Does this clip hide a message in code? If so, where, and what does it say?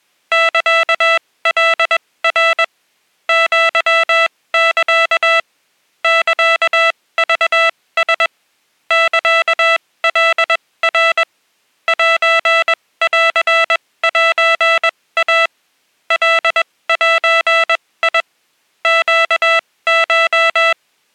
Yes: Morse code (Japanese Wabun code) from 0.3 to 20.8 s, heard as electronic beeps, machine-sent, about 21 wpm, spaced as for 17 wpm, 660 Hz. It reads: サカナ アサ サクラ サカナ センセイ カゼ ネコ